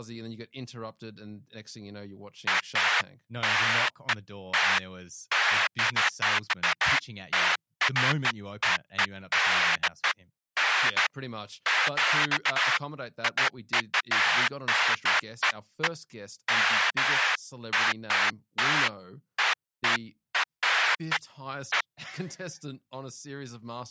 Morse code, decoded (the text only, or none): none